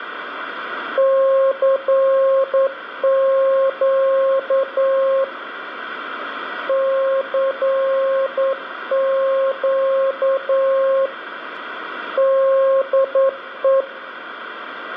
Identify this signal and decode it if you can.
Morse code, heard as a keyed tone, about 9 wpm, 540 Hz, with radio static and room echo. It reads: CQ CQ DE